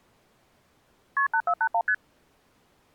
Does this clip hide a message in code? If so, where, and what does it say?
Yes: multi-frequency trunk signalling (R1, as on North American trunks) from 1.2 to 1.9 s, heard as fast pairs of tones, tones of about 70 ms. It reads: KP 8481 ST